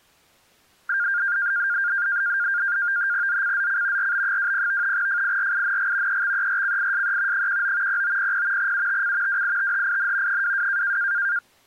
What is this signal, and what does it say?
NAVTEX (SITOR-B), 100 baud, 170 Hz shift, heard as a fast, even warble, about 1500 Hz centre. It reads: ZCZC RB20 FIRING EXERCISE 19 0900 UTC WITHIN 22